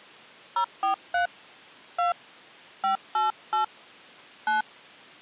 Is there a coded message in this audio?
Yes: DTMF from 0.6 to 4.6 s, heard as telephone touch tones, dialled by hand, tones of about 130 ms. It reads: 043 2 588 9